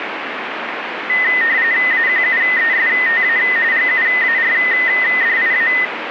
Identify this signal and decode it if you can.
RTTY (45.45 baud, 170 Hz shift), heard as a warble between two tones, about 1950 Hz centre, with radio static. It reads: AQUESTA GUARDIA